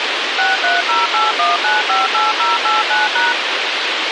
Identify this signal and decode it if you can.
DTMF, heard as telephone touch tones, dialled by machine, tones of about 170 ms, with radio hiss. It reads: 63081958089#